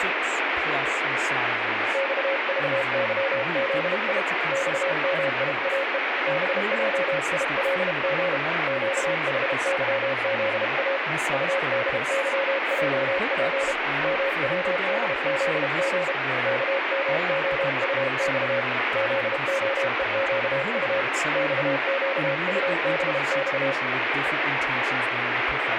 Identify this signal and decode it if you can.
Morse code, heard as a keyed tone, hand-sent with a paddle, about 32 wpm, 550 Hz, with radio static and speech in English. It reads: XVYZI XMIAE BJILG QHYZA UDYJP MWDZG KMOUX ZOEQU XQUBX